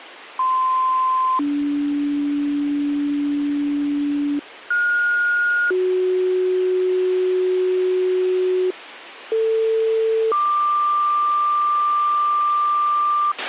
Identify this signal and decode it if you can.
Two-tone page, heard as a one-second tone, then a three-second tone, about 1040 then 290 Hz, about 1430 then 370 Hz, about 450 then 1180 Hz, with radio hiss and a squelch burst at the end.